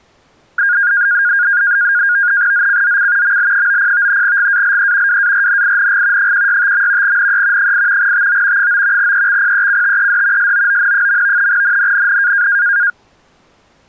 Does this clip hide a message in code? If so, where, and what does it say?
Yes: NAVTEX (SITOR-B), 100 baud, 170 Hz shift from 0.6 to 12.9 s, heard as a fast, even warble, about 1550 Hz centre. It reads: ZCZC ML90 GALE WARNING 165. NE 8 TO 9 EXPECTED SOON. NNNN